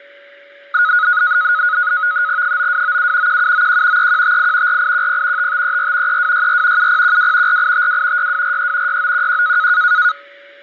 NAVTEX (SITOR-B), 100 baud, 170 Hz shift, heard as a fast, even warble, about 1360 Hz centre, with a steady whistle near 570 Hz. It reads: 9297 1791 3158 4810 5534 3264 7012 4852 6243 6911